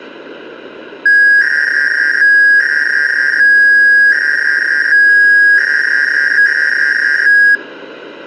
300-baud modem data (V.21 tones), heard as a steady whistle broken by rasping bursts, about 300 baud, 200 Hz shift.